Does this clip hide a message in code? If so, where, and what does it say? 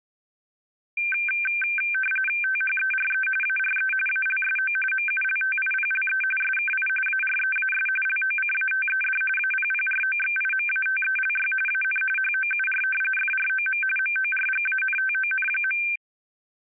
Yes: RTTY (45.45 baud, 850 Hz shift) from 1.0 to 16.0 s, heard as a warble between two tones, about 1950 Hz centre. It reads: THERE ARE ALSO MULTIPLE SKI AREAS LOCATED APPROXIMATELY AN HOUR FROM MORGANTON.